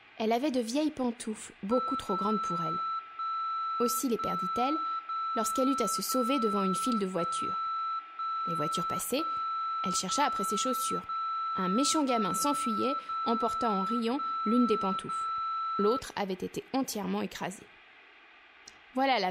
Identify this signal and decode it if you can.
Radio time signal (DCF77), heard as a tone whose level steps once a second, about 1330 Hz, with room echo. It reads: 0 1 1 0 0 1 1 1 0 0 0 0 1 0